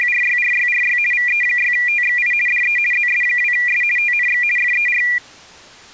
RTTY (50 baud, 450 Hz shift), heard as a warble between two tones, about 2200 Hz centre. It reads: … VE6TXI DE ZS2S TNX FER